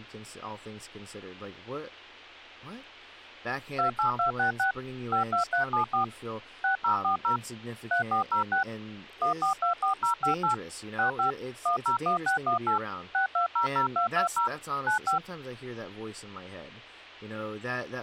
DTMF, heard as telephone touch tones, dialled by machine, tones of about 110 ms, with speech in English. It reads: 28266 52374 6040 3406 1424058 65 101618 6200220 95